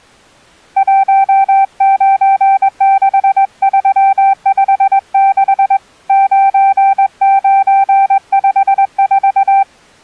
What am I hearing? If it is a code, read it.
Morse code, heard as a keyed tone, hand-sent with a straight key, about 21 wpm, 780 Hz. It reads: 196356 9954